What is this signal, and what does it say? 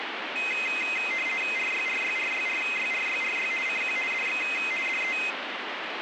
RTTY (50 baud, 450 Hz shift), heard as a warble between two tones, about 2300 Hz centre, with radio static. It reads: RYRYRYRYRYRY CQ DX DE